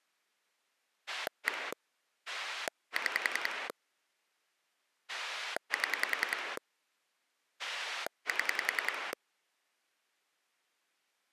Pulse dialling, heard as a rotary dial, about 10 pulses a second. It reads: 1 6 7 7